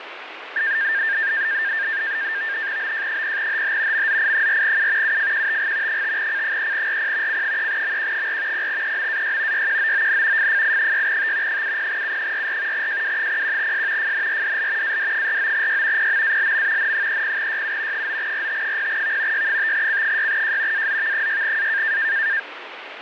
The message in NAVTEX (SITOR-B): BJ0HH MZI4U UFQTG 5C3RP C3MQ4 0EMAY YQOON FFI6T 70U44 JW01S FNRDL AD49Y PMALM N30YU 9RT0V Y5C6J AZV6A

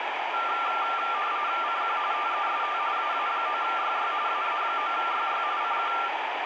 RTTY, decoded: CQ TEST AA9YY AA9YY CQ

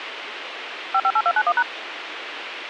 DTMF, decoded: 558291#

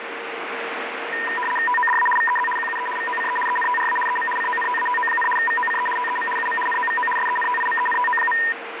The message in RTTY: TODA VEZ QUE VOCE ENTRA EM CONTATO, VOCE TEM UM NOVO SENTIMENTO.

